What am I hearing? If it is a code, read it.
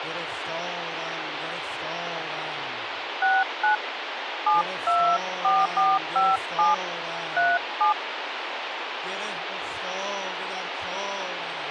DTMF, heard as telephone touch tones, dialled by hand, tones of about 210 ms, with phone line noise. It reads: 69 724457 37